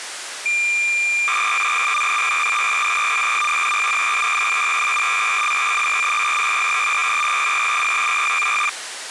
Cassette data (Kansas City type), 300 baud, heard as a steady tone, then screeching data, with tape hiss.